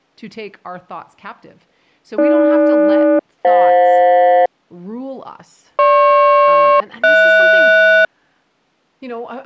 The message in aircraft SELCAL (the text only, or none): AG-FJ GP-HS